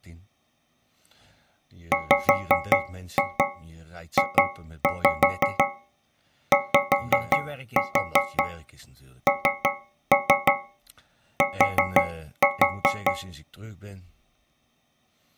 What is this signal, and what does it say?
Tap code, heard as taps on a metal pipe, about 5 knocks a second, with speech in Dutch. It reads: WJYNT